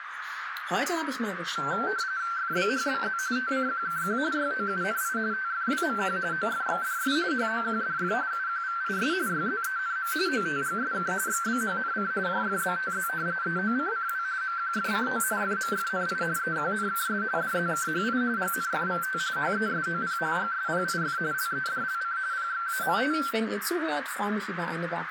RTTY (45.45 baud, 170 Hz shift), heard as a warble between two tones, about 1450 Hz centre, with radio static and a narrow filter. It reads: FBHBZ TCQKQ YOUNI TFWMQ OFXDS HOQDF UQVIS YZENM OTGSK XBHNC JFBTZ EOCCW MQFCO FMFNI EQNKS DZKHI GNFVT HESOP GSPIF LEDLC PXAMT